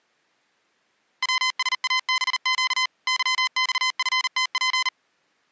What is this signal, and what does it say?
Morse code, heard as electronic beeps, machine-sent, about 39 wpm, 1030 Hz. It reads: WSABQ YXFTP